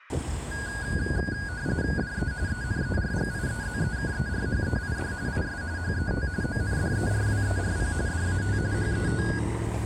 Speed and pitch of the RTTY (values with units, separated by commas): 45.45 baud, 170 Hz shift, 1550 Hz centre